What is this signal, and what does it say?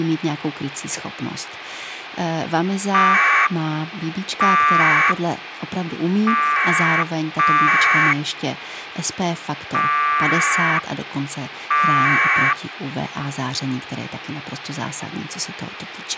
Packet radio (AX.25, as in APRS), 1200 baud, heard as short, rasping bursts, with radio hiss and speech in Czech.